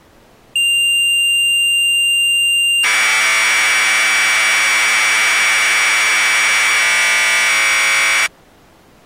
Commodore tape loading (standard loader), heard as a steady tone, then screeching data.